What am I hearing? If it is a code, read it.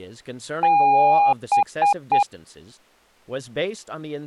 Beep code, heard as beeps, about 810 Hz, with speech in English. 1 long, 3 short. In Award and IBM BIOS tables: video adapter failure; in AMI BIOS tables: memory failure.